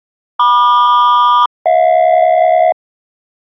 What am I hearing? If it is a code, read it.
Aircraft SELCAL, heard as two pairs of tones. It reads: MQ-HJ